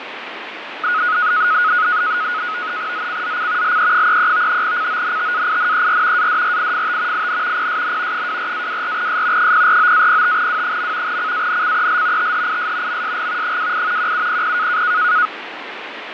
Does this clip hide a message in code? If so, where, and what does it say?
Yes: NAVTEX (SITOR-B), 100 baud, 170 Hz shift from 0.8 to 15.3 s, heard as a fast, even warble, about 1360 Hz centre, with radio static and fading. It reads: ZCZC LE33 CONTAINER ADRIFT IN PSN 24-24S 049-05W. CANCEL THIS MSG 28 1700